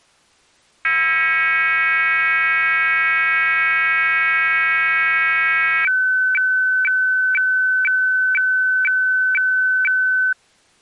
Weather fax (radiofax), 120 lines a minute, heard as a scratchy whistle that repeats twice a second.